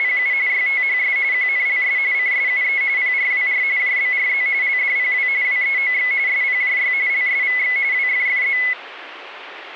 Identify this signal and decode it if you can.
RTTY (45.45 baud, 170 Hz shift), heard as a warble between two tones, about 2100 Hz centre, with radio static. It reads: … YTHS QNLS CSUE PRWR JBRZ LDPW WEOX SPJY LSVX WFFZ